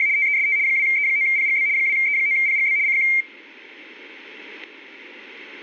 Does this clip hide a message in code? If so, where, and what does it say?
Yes: RTTY (75 baud, 170 Hz shift) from 0.0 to 3.2 s, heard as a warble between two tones, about 2200 Hz centre. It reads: … TEST 2E9PGB 2E9PGB CQ